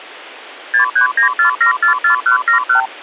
Multi-frequency trunk signalling (R2, with the far end's replies), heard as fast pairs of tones, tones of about 110 ms. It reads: 6394744171